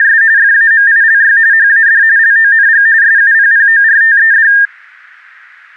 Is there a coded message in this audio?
Yes: RTTY (45.45 baud, 170 Hz shift) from 0.0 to 4.7 s, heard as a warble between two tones, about 1700 Hz centre. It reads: … FAMILY HAD LONG SUPPORTED